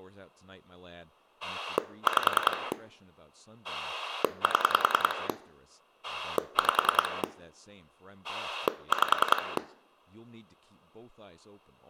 Pulse dialling, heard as a rotary dial, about 10 pulses a second, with room echo and speech in English. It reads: 5 7 5 5